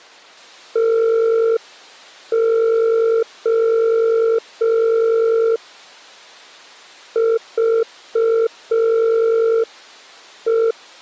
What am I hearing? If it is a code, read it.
Morse code (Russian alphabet), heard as a keyed tone, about 5 wpm, 450 Hz. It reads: ТО ЖЕ